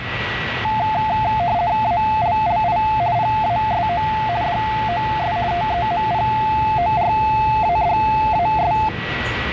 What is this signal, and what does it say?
RTTY (50 baud, 170 Hz shift), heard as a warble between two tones, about 780 Hz centre, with radio static, a steady whistle near 1940 Hz and the noise inside a subway train. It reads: ALLI PASO DOS TEMPORADAS